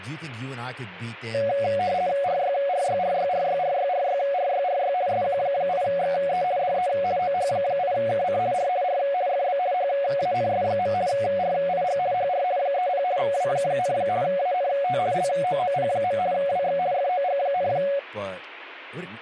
RTTY (50 baud, 170 Hz shift), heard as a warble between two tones, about 640 Hz centre, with speech in English. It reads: RYRYRYRYRYRYRYRY SQ8XE DE OH8KC R R FB HANS. RIG HR 30 W, ANT LOOP. WX FOG,